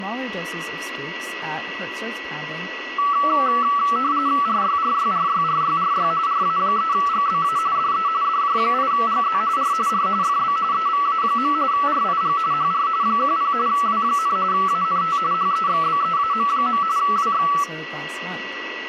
RTTY (45.45 baud, 170 Hz shift), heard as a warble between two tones, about 1230 Hz centre, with radio static, a steady whistle near 1940 Hz and speech in English. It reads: RYRYRYRYRY RA3GBA DE DJ8GZ R R FB EVA. RIG HR 10 W, ANT HEXBEAM. WX